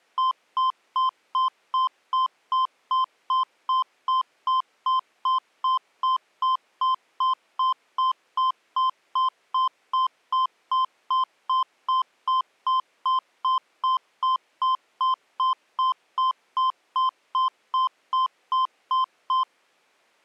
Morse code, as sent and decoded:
none

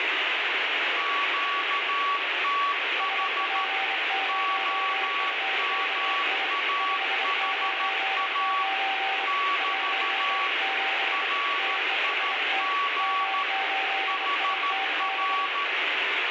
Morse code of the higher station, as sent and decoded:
--.- - .... / --- -- .- .... .- / -...- / .-. .. --. / .... .-.
QTH OMAHA <BT> RIG HR

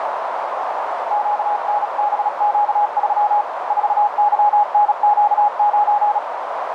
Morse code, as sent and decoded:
--.- -. -... --.- ...-- / ....- -.-- -. --.- ----.
QNBQ3 4YNQ9

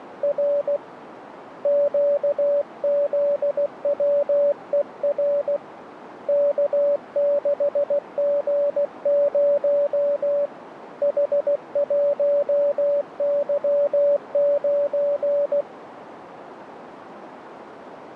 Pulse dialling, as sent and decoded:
none

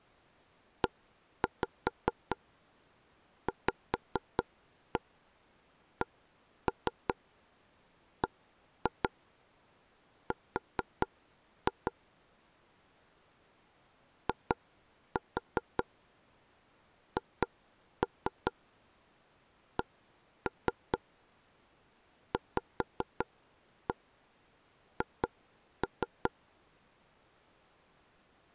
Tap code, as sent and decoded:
1-5 5-1 1-3 1-2 4-2 / 2-4 2-3 1-3 5-1 2-3
EVCBR IHCVH

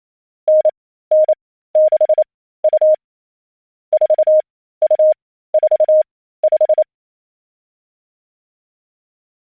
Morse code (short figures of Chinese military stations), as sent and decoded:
-. -. -.... ..- / ....- ..- ....- .....
9962 4245

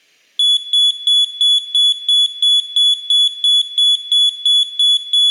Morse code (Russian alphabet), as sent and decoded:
none

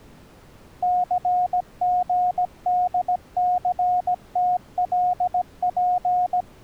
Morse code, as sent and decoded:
-.-. --. -.. -.-. - .-.. .--.
CGDCTLP

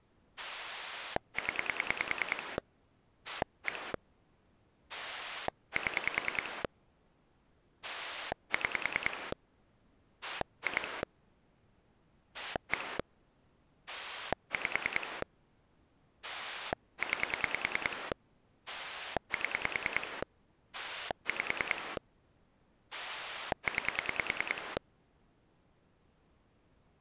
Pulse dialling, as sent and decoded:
10 / 1 / 7 / 6 / 2 / 1 / 5 / 9 / 7 / 5 / 9
0 1 7 6 2 1 5 9 7 5 9

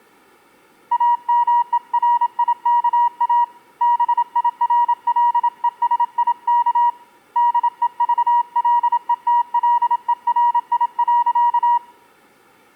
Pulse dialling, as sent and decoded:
none

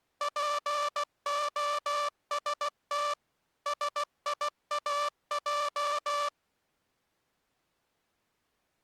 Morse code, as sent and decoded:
.--. --- ... - / ... .. .- .---
POST SIAJ

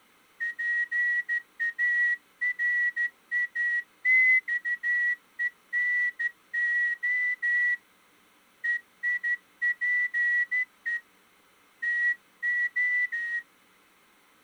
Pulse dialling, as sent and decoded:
none

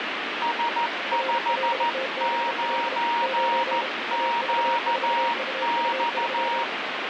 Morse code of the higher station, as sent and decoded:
... ..... ----. --.- -..-
S59QX

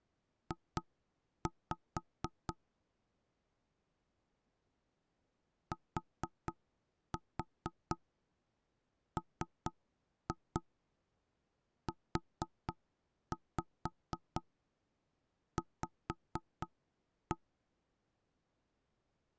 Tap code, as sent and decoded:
2-5 / 4-4 3-2 4-5 5-1
J TMUV

